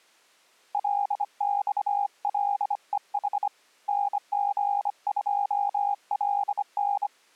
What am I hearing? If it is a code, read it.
Morse code, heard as a keyed tone, hand-sent with a bug key, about 25 wpm, 810 Hz. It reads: LXLEH NG2LN